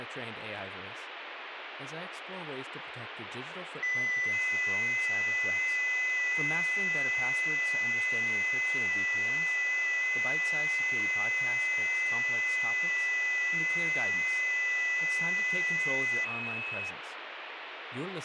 FT8 (several signals at once), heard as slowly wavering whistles, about 6.25 baud, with radio static and speech in English.